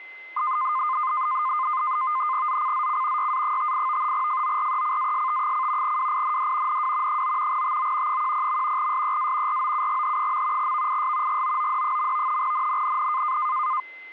NAVTEX (SITOR-B), 100 baud, 170 Hz shift, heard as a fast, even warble, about 1130 Hz centre, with a steady whistle near 2060 Hz. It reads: ZCZC YA58 FORECAST: WIND NW 9 TO 10. SEA ROUGH. VIS GOOD. NNNN